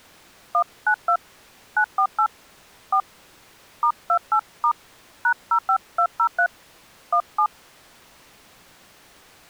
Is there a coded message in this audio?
Yes: DTMF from 0.5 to 7.5 s, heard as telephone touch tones, dialled by hand, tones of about 80 ms. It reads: 192 948 4 *28* #05203 17